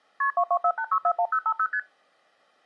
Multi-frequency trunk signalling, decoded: KP 2248641050 ST

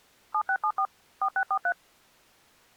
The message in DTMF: 7674 4643

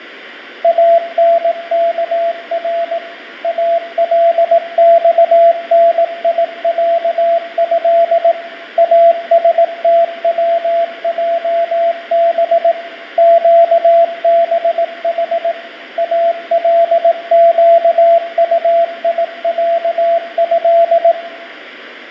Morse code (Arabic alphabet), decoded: انكر الصنيعه استوجب قبح القطيعه

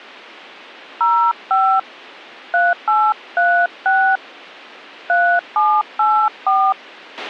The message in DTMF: 05 3836 3784

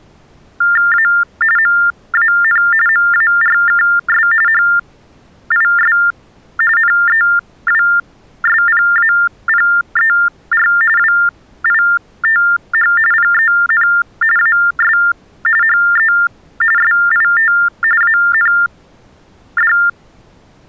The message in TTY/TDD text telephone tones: A MAN MARKS HIS NEWSPAPER WITH PEN AS HE SIT AND

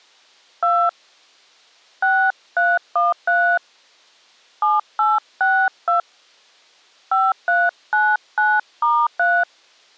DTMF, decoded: 2 6313 7862 5399*3

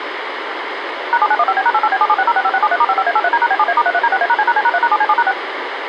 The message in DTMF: #7915B#88B776065673*55A83D#B7A*33D6A#C#C#3#7C7#6

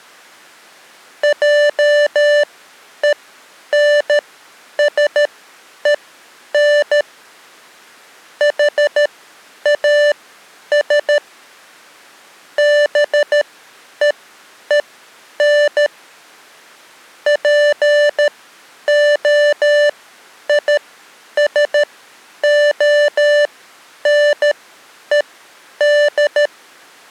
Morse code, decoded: JENSEN HAS BEEN POISONED

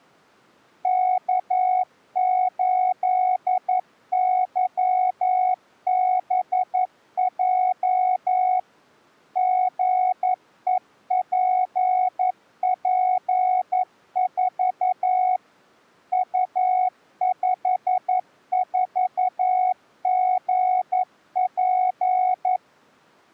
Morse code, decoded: K8YBJ GEPP4 U54GP

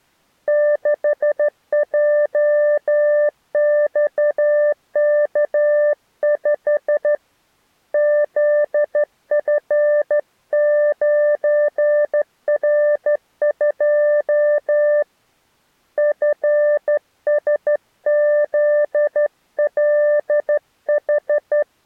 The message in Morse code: 6JXK5 ZF9R2 FSZLH

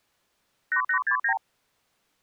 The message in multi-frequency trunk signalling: 8869

